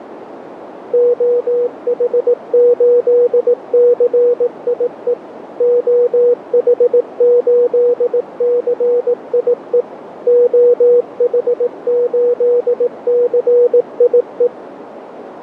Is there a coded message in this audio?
Yes: Morse code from 0.9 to 14.5 s, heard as a keyed tone, machine-sent, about 18 wpm, 480 Hz, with radio static and a narrow filter. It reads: OH8CIE OH8CIE OH8CIE